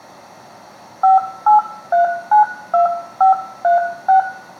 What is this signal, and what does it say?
DTMF, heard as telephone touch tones, dialled by hand, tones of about 130 ms, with room echo. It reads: 58392536